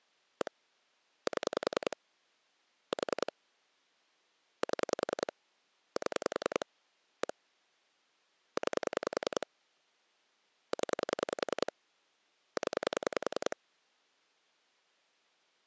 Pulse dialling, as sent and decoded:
1 / 7 / 4 / 7 / 7 / 1 / 9 / 10 / 10
1 7 4 7 7 1 9 0 0

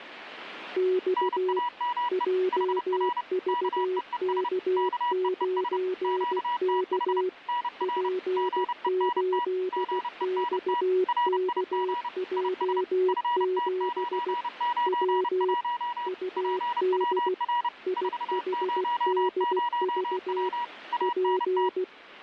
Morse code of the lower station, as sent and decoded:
-..- / .--- ...- -.- ----. -.- / .--. ---.. -..- -.- .--- --... / .-- / ..- -.. / .. .... -.. ...- / .--.
X JVK9K P8XKJ7 W UD IHDV P

